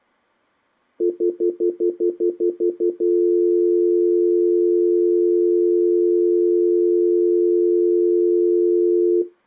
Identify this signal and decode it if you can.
Telephone call progress tone (North American plan), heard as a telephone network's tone, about 350, 440 Hz, 0.1 s on and 0.1 s off. Stutter dial tone.